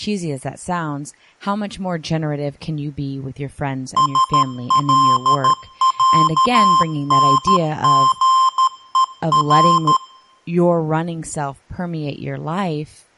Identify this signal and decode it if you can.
Morse code (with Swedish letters), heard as electronic beeps, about 13 wpm, 1050 Hz, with speech in English. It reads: SLÄNGER